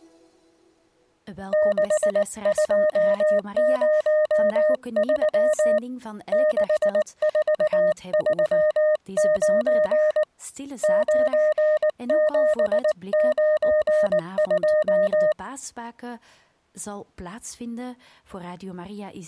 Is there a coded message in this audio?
Yes: Morse code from 1.5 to 15.4 s, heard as a keyed tone, hand-sent with a paddle, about 19 wpm, 610 Hz. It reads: 6203 6439 9792